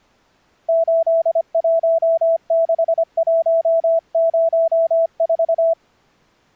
Morse code, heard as a keyed tone, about 25 wpm, 660 Hz. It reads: 816104